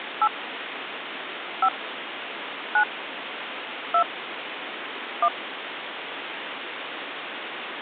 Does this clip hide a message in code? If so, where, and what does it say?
Yes: DTMF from 0.2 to 5.3 s, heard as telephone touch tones, dialled by hand, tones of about 80 ms, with phone line noise. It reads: 8 5 9 2 1